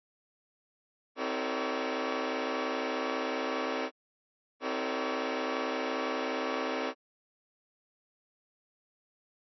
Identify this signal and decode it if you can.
Train horn signal, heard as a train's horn. 2 long. On North American railways: brakes released, proceed.